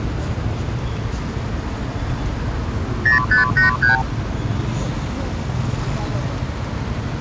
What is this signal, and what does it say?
Multi-frequency trunk signalling (R2, with the far end's replies), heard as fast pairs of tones, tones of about 130 ms, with street noise. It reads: 0583